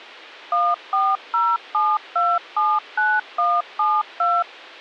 DTMF, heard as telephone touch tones, dialled by machine, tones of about 230 ms. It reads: 1407279172